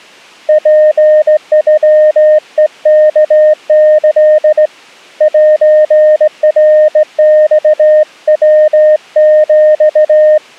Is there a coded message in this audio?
Yes: Morse code (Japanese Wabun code) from 0.4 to 10.4 s, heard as a keyed tone, hand-sent with a straight key, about 17 wpm, 610 Hz. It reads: ツノヘワキ セナマヤヒ